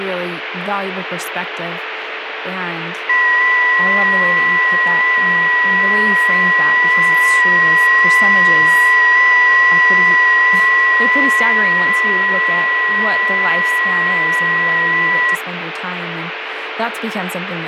FT8 (several signals at once), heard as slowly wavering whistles, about 6.25 baud, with radio static and speech in English.